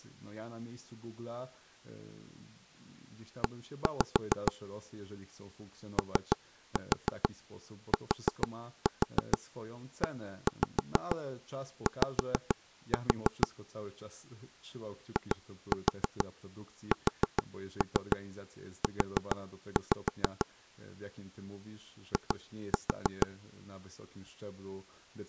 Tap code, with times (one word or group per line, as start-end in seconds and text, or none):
3.4-4.5 E
6.0-13.5 OTEY
15.2-20.5 ISU
22.1-23.3 I